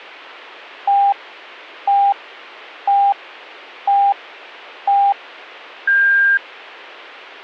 Radio time signal (five pips and a higher one, as on Chinese radio), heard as pips.